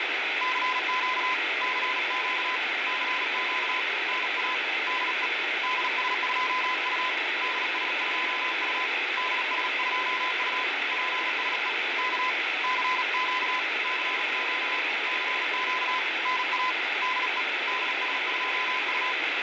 Morse code, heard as a keyed tone, hand-sent with a paddle, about 37 wpm, 1020 Hz, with heavy radio static and fading. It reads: CQ CQ CQ NA DE DS2U DS2U DS2U PSE K CQ CQ CQ NA DE DS2U